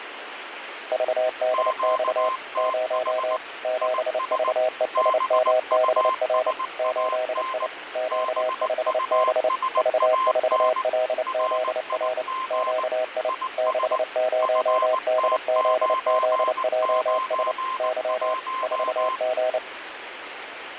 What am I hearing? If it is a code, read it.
Morse code, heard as two keyed tones, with radio static. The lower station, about 29 wpm, 630 Hz: VDX 0 7VESMBR 8I Q5B V4LZR QI 60DZZJS Y 4G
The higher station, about 19 wpm, 1040 Hz: QTH IS BUSAN BUSAN RIG IS FT991